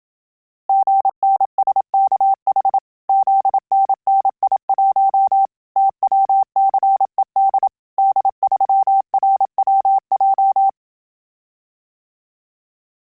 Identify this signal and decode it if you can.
Morse code, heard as a keyed tone, machine-sent, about 27 wpm, 780 Hz. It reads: GNSKH ZNNI1 TWCED D3RWJ